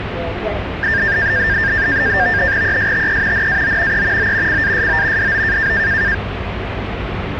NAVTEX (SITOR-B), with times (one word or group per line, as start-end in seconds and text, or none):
2.6-3.5 ESTE
3.3-4.0 NAO
3.9-4.3 E
4.2-4.6 O
4.5-5.3 CASO
5.2-5.7 DO